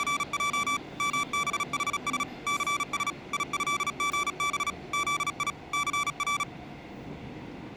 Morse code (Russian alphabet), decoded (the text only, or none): … МБХС ЦС ИЭГБ ЗИ ЦР